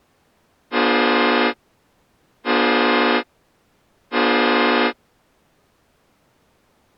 Train horn signal, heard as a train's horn. 3 short. On North American railways: when stopped, the train will back up.